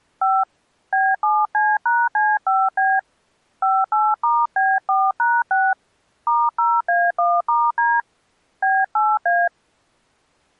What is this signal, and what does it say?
DTMF, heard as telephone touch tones, dialled by hand, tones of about 220 ms. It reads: 5 B7C#C5B 58*B4#6 *0A1*D B8A